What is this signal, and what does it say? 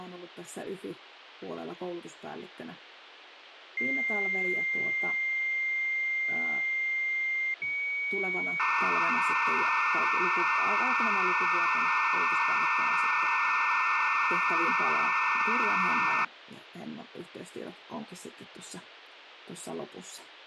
Dial-up modem handshake (low-speed, two carriers), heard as two whistles, then hiss, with phone line noise.